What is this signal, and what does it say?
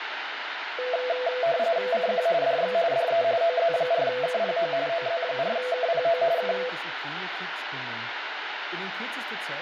RTTY (45.45 baud, 170 Hz shift), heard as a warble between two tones, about 590 Hz centre, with radio static, room echo and speech in German. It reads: CQ DX DE OZ4KPO OZ4KPO K